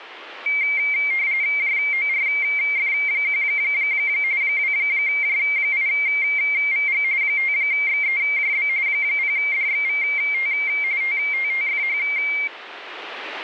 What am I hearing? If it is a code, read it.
RTTY (45.45 baud, 170 Hz shift), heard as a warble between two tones, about 2200 Hz centre, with radio static. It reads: JORF1 2J8VG 5XEJB 0DXVT TTTFH